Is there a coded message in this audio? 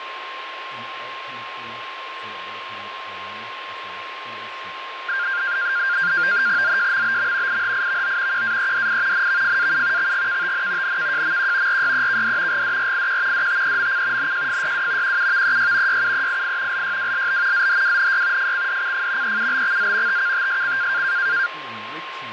Yes: NAVTEX (SITOR-B), 100 baud, 170 Hz shift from 5.1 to 21.5 s, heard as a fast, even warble, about 1500 Hz centre, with radio static and a steady whistle near 1060 Hz. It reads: ZJMBM IHIVO QAEDI NVFAU XGKTN NKJMQ RYEKD GDRIQ DTEMC NJFYW QUVEY YUEII LYWLB ZHWNY FCDCF EUBXZ TKTSC